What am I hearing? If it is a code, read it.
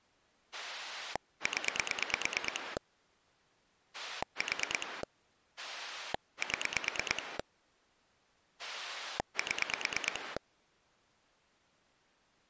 Pulse dialling, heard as a rotary dial, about 9 pulses a second. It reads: 0 4 7 7